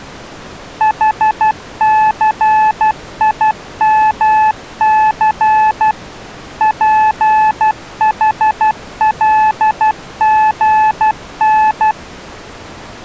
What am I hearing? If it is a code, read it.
Morse code, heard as a keyed tone, machine-sent, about 12 wpm, 860 Hz. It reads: HCIMC PHLGN